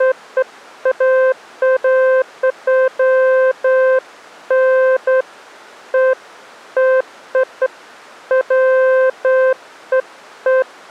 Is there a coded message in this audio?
No, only beeps of irregular length.